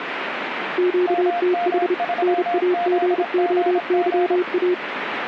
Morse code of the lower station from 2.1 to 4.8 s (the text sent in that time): NAGOYA